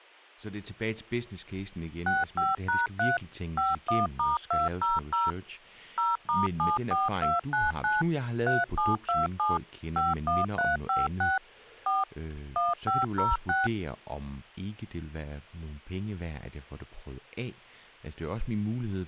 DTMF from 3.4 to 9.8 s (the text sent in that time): 51*200 0*74299 3727